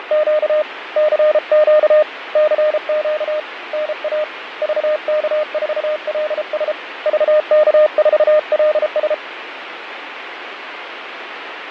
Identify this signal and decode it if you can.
Morse code, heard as a keyed tone, hand-sent with a paddle, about 33 wpm, 610 Hz, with radio static and fading. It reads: … CQ CQ NA VK4LS VK4LS